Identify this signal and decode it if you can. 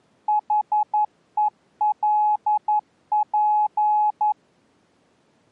Morse code, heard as a keyed tone, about 11 wpm, 840 Hz. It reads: HELP